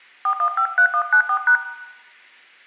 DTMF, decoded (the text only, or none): 4153194#